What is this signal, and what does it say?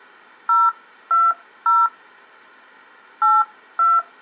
DTMF, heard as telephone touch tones, dialled by hand, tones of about 200 ms. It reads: 020 82